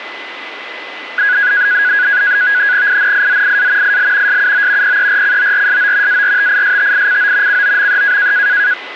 NAVTEX (SITOR-B), 100 baud, 170 Hz shift, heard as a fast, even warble, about 1550 Hz centre, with radio static and a steady whistle near 2020 Hz. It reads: INIZIA IL SUO PERCORSO ARTISTICO COME